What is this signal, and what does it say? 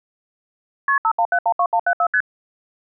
Multi-frequency trunk signalling (R1, as on North American trunks), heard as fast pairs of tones, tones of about 70 ms. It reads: KP 51712174 ST